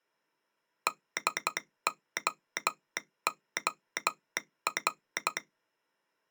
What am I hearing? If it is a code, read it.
Morse code, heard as a telegraph sounder, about 12 wpm. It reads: DOOR